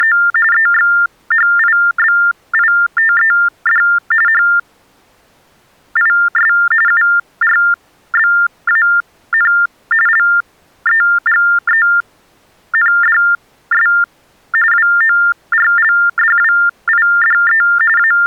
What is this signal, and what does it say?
TTY/TDD text telephone tones (45.45 baud Baudot), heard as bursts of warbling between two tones, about 400 Hz shift, 1600 Hz centre. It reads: … EXHIBITED HIS URBAN LEGENDS WORLDWIDE …